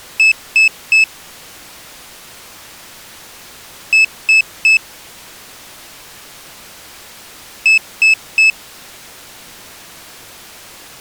Beep code, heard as a piezo beeper, played three times, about 2600 Hz. 3 short. In AMI BIOS tables: failure in the first 64 KB of memory; in Dell tables: chipset error.